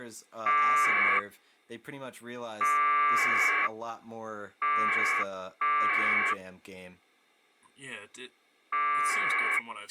Packet radio (AX.25, as in APRS), 1200 baud, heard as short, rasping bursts, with speech in English.